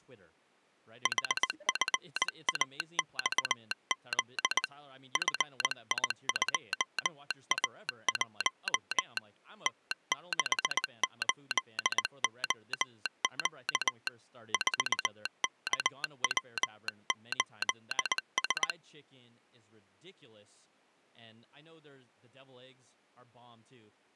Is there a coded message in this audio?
Yes: Morse code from 1.0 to 18.8 s, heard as a telegraph sounder, hand-sent with a bug key, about 19 wpm, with speech in English. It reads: HFAXZ FI2A1 T68OQ 4KW8S